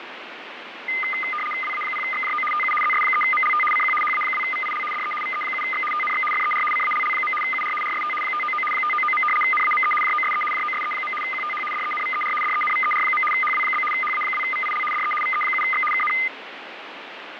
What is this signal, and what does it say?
RTTY (75 baud, 850 Hz shift), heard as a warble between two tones, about 1650 Hz centre, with radio static. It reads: WA0XJO TU ZS3MLT CQ HA2VIL DE VE7X TNX FER CALL. UR RST 599 599. NAME JOSE JOSE. QTH DENVER DENVER. HW? HA2VIL DE VE7X KN